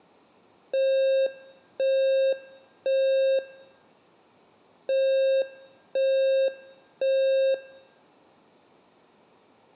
Alarm pattern, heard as an alarm's beeps, played twice, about 540 Hz, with room echo. Temporal three. Smoke or fire, evacuate.